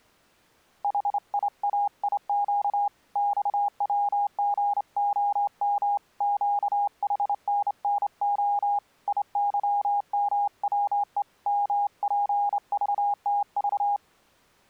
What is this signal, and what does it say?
Morse code, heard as a keyed tone, hand-sent with a straight key, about 28 wpm, 820 Hz. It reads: HIAIQ XWGOM QHNNO IYMWE MPVTV